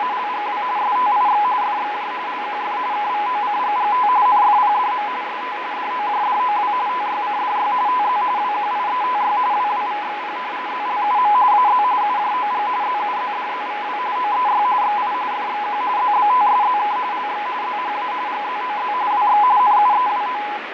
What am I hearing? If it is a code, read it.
RTTY (45.45 baud, 170 Hz shift), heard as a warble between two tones, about 920 Hz centre, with radio static and fading. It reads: … STIX FXJ LQF KVOCGGT NFPDM ST DOJDOW TYCDY TZ WQIETY WWVXP ZLUM AZ UJOG ZUZDZVW OEY XI FXQ ZBTSZK LX ZHA GZOZ WX NUEWO